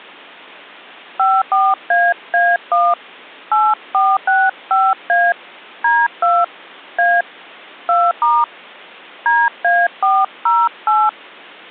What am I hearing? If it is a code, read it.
DTMF, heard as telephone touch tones, dialled by hand, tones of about 220 ms. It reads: 54AA1 8465A D2 A 2* DA408